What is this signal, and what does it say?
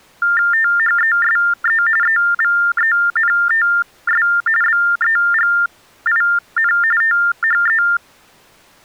TTY/TDD text telephone tones (45.45 baud Baudot), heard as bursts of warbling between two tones, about 400 Hz shift, 1600 Hz centre. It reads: THESE EVENTS BEGIN THE